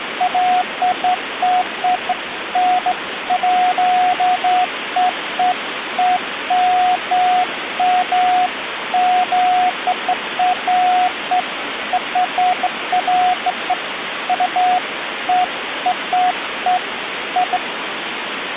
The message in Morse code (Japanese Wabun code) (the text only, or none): none